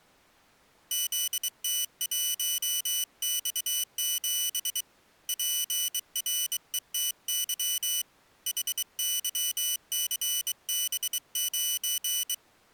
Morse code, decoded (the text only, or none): ZT1X7 PRETY HYCB9